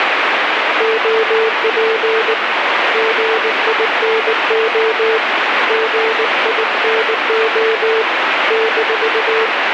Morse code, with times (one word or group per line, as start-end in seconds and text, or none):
0.8-2.3 OP
2.9-5.2 GINO
5.7-8.0 GINO
8.5-9.5 -